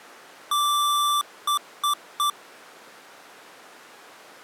Beep code, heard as beeps from a small speaker, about 1170 Hz. 1 long, 3 short. In Award and IBM BIOS tables: video adapter failure; in AMI BIOS tables: memory failure.